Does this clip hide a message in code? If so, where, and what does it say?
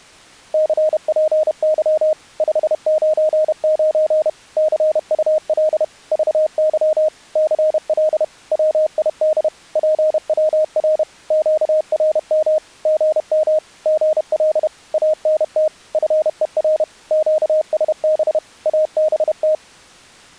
Yes: Morse code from 0.5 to 19.6 s, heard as a keyed tone, machine-sent, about 31 wpm, 620 Hz. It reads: CPY 599 CUL VY CL WID PWR QRM GM GL ANT FER QSB ABT